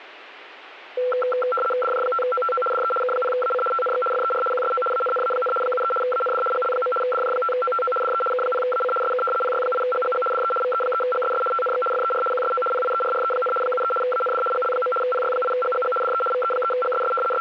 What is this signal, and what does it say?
RTTY (75 baud, 850 Hz shift), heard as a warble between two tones, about 930 Hz centre. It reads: DJ5OTO DE K0AC TNX FER QSO ANNA, 73 AND GL. DJ5OTO DE K0AC SK PY8GGG DE VE3GSS TNX FER QSO PIERRE, 73 AND GL. PY8GGG DE VE3GSS …